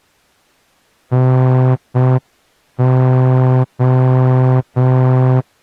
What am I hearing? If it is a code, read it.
Morse code, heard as a horn, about 6 wpm. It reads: NO